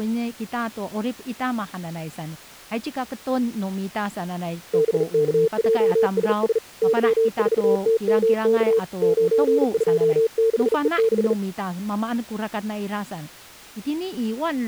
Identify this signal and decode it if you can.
Morse code, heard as a keyed tone, hand-sent with a bug key, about 39 wpm, 450 Hz, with speech in Chinese. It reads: BKJSS Y4TMK 926E6